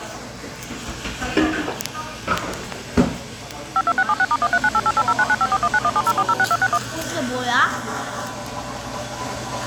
DTMF, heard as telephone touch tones, dialled by machine, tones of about 50 ms, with the noise of a cafe. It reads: 52676*1398880995419170406261